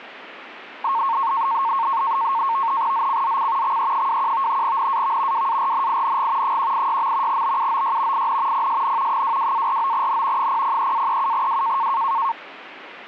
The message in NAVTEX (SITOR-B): ZCZC XE21 NAV WARNING 186. BUOY IN PSN 22-49N 003-37W

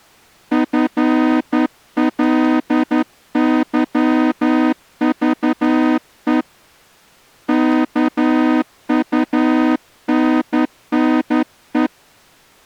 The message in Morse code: FLYVE KUNNE

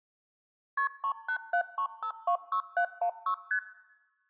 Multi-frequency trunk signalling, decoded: KP 3873526716 ST

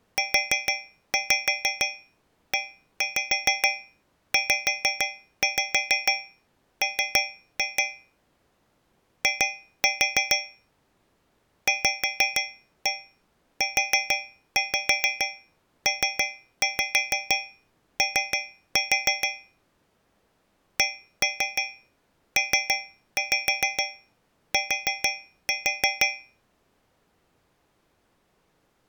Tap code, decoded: UEZM I VUPO CPT

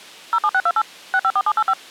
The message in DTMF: 07628 654785

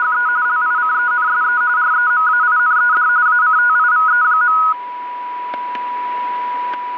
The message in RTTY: … LICENSE REMAINED ACTIVE.

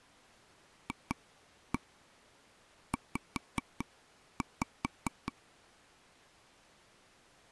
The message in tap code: FZ

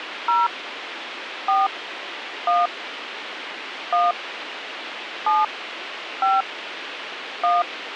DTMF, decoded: 0 4 1 1 7 5 1

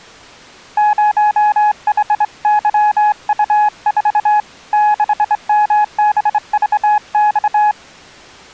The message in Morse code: 0HYU4 6MBVX

